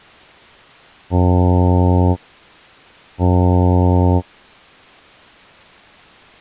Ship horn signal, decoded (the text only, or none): 2 short